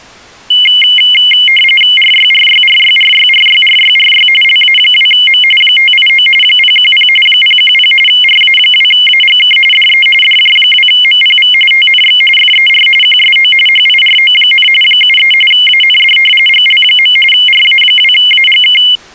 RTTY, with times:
2.0-4.3 RYRYRYRYRYRYRY
4.4-5.4 LA2M
5.6-6.3 589
6.4-7.1 010
7.3-7.9 010
8.1-9.6 RA2AGK
9.7-10.1 DE
10.2-11.5 DJ2MPV
11.7-12.2 TNX
12.4-12.9 FER
13.0-13.5 QSO
13.7-14.7 HIRO,
14.8-15.3 73
15.5-16.2 AND
16.5-17.2 GL.
17.3-18.8 RA2AGK

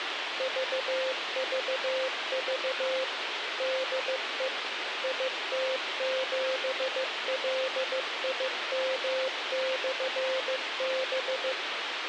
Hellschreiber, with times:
none

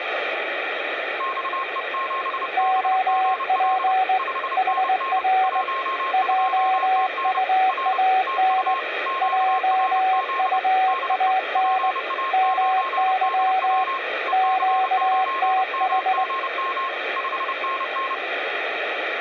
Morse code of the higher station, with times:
1.2-3.9 XE7BGL
4.2-5.2 5NN
5.4-7.4 12TN
7.7-8.0 R
8.3-8.8 TU
9.1-10.6 QRZ
10.9-11.3 DE
11.6-14.0 PA9DW
14.3-16.9 EC9MGM
17.2-18.1 5NN

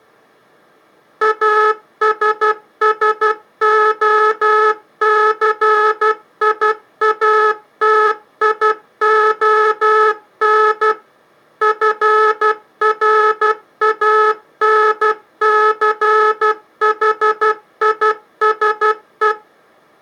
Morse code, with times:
1.2-10.9 ASSOCIATION
11.6-19.3 FRANCHISE

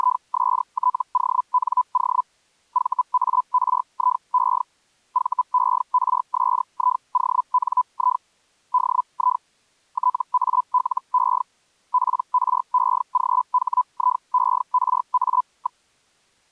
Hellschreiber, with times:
0.0-2.2 …
2.7-4.6 VARIE
5.1-8.2 VERSIONI
8.7-9.4 DI
9.9-11.4 TALE
11.9-15.8 PREGHIERA.

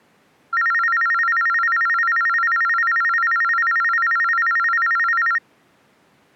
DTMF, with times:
none

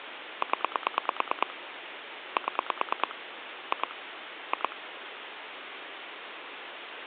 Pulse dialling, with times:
0.4-1.5 0
2.4-3.1 7
3.7-3.9 2
4.5-4.8 2

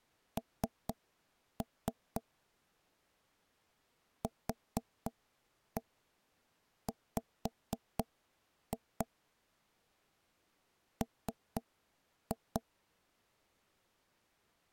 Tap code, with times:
0.4-2.2 N
4.2-9.1 QW
11.0-12.6 M

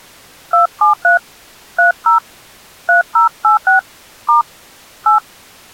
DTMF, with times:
0.5-1.2 273
1.8-2.2 30
2.9-3.8 3086
4.3-4.4 *
5.1-5.2 8

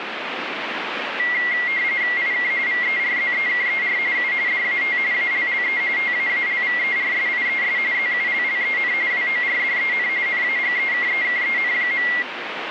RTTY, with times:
2.2-2.5 IK
2.7-4.0 VERZEKER
4.2-4.3 U
4.5-5.0 DAT
5.1-5.8 ALLE
6.0-7.8 TAALVERSIES
7.9-8.9 ZULLEN
9.1-10.1 WORDEN
10.3-12.1 NAGEKEKEN.

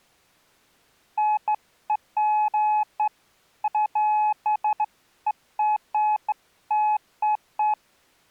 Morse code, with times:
none

